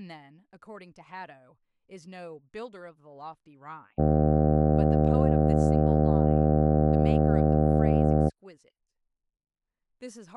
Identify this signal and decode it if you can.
Ship horn signal, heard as a ship's horn, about 80 Hz, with speech in English. 1 long. At sea: a vessel nearing a blind bend, or under power and making way in fog.